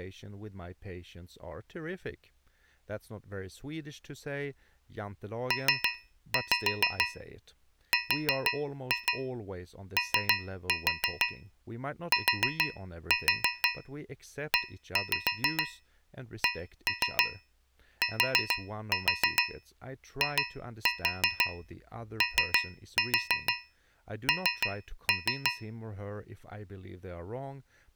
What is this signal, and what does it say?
Tap code, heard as taps on a metal pipe, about 6 knocks a second, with speech in English. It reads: PROTECTION